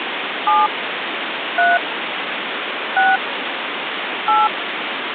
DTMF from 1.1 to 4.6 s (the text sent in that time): 3 6 8